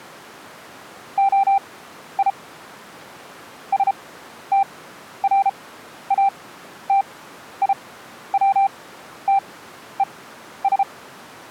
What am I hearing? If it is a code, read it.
Morse code (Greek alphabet), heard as a keyed tone, machine-sent, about 33 wpm, spaced as for 12 wpm, 790 Hz. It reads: ΟΙ ΣΤΡΑΤΙΩΤΕΣ